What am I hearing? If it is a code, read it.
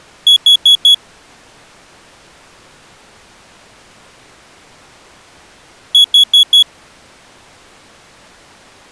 Alarm pattern, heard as an alarm's beeps, played twice, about 3350 Hz. Temporal four. Carbon monoxide.